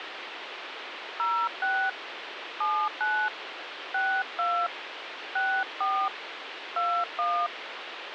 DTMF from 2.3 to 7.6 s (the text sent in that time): 79 62 64 21